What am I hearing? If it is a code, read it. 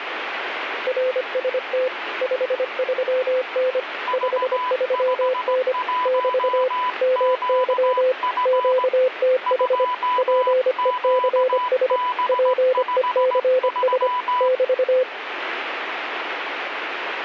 Morse code, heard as two keyed tones, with radio static. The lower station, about 25 wpm, 510 Hz: RST 53N 53N <BT> MY QTH PECS PECS <BT>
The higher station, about 17 wpm, 1000 Hz: V51QF 2QB53